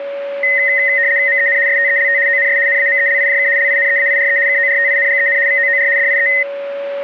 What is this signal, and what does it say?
RTTY (75 baud, 170 Hz shift), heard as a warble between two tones, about 1950 Hz centre, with a steady whistle near 560 Hz. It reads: MEN STELT ONS NAMELIJK LINEAIRE KORTINGEN VOOR DIE